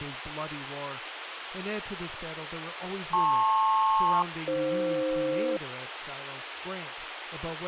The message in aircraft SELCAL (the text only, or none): LP-AF